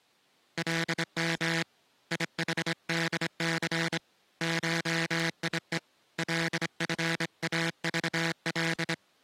Morse code (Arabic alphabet), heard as a buzzer, hand-sent with a straight key, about 25 wpm. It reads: لم يحدث شيء لفاضل